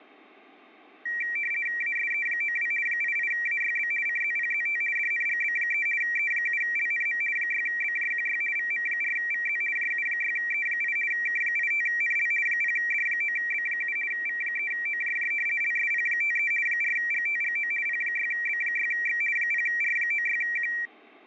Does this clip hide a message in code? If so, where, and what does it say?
Yes: RTTY (50 baud, 450 Hz shift) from 1.1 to 20.9 s, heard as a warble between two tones, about 2100 Hz centre. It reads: ASE92 88AYB CZPZT DNGB3 E7LNM 6BJQY VM4VZ JU6E8 K85NL 0D9B7 V3OJJ LSP53 4GTGO P6B6X 0R96Q